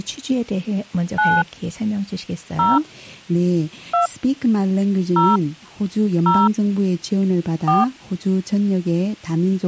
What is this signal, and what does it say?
DTMF, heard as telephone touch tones, dialled by hand, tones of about 170 ms. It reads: 9 0 2 0 0 4